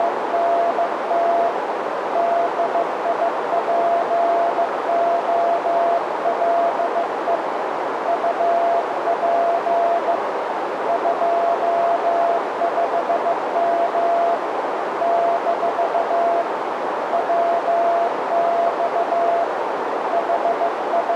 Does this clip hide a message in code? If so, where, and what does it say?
Yes: Morse code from 0.0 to 21.2 s, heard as a keyed tone, hand-sent with a bug key, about 15 wpm, 680 Hz, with heavy radio static and a narrow filter. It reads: … DIPOLE UP 25M - WX …